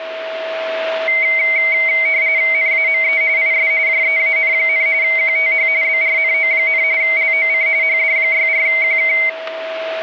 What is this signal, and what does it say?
RTTY (45.45 baud, 170 Hz shift), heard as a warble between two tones, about 2150 Hz centre, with a steady whistle near 650 Hz. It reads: NAME IS JEAN, QTH BRNO, LOC HD64QK